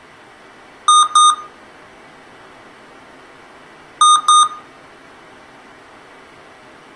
Beep code, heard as beeps from a small speaker, played twice, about 1230 Hz, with room echo. 2 short. In AMI BIOS tables: memory parity error; in IBM BIOS tables: self-test error shown on screen; in Dell tables: no memory detected.